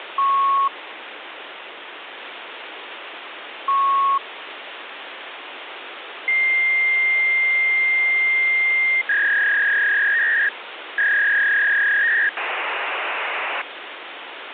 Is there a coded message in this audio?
Yes: fax machine handshake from 0.2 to 13.6 s, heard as beeps, a long tone, a warble and hiss, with phone line noise.